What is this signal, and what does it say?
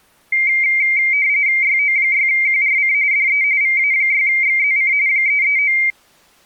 RTTY (45.45 baud, 170 Hz shift), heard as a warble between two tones, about 2200 Hz centre. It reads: YO6QRC DE VA6XZC 339